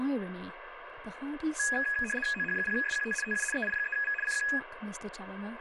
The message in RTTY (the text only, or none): OH0SQT TU EI3V CQ